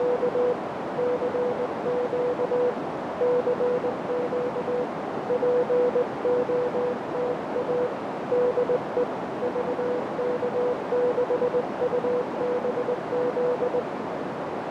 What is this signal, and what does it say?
Morse code, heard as a keyed tone, hand-sent with a straight key, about 19 wpm, 490 Hz, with heavy radio static and a narrow filter. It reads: … CQ CQ POTA DE VK6UBZ